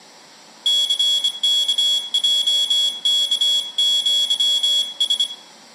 Morse code (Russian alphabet), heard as a high beeper, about 25 wpm, 3350 Hz, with room echo. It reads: ЦКЙКЪС